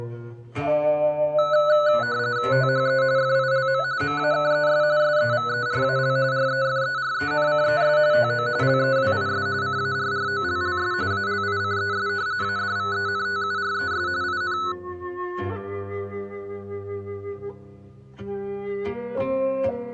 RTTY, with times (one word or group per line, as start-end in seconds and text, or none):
2.5-3.0 THE
3.2-3.8 FILM
4.0-4.8 MAKES
5.0-6.2 SEVERAL
6.3-8.0 REFERENCES
8.1-8.5 TO
8.6-9.5 LEWIS
9.6-10.9 CARROLLS
11.1-12.1 ALICES
12.4-14.1 ADVENTURES
14.2-14.6 IN